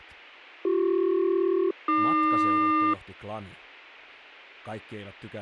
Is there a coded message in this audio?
Yes: aircraft SELCAL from 0.6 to 2.9 s, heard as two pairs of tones, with speech in Finnish. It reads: BC-AQ